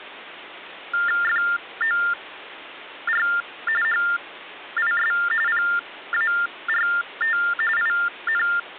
TTY/TDD text telephone tones (45.45 baud Baudot), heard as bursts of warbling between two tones, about 400 Hz shift, 1600 Hz centre. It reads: FOR HIS PART IN